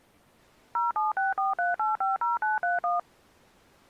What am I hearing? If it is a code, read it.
DTMF, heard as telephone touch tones, dialled by machine, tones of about 160 ms. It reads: 07643850931